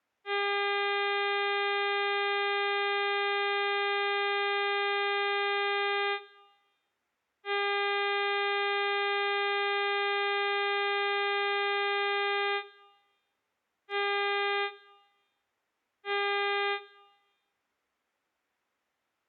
Ship horn signal, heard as a ship's horn, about 400 Hz. 2 long, 2 short. At sea: I intend to overtake on your port side.